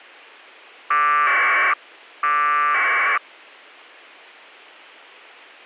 Packet radio (AX.25, as in APRS), 1200 baud, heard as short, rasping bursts, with a squelch burst at the end.